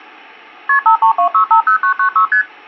Multi-frequency trunk signalling (R1, as on North American trunks), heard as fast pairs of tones, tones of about 100 ms. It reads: KP 532650996 ST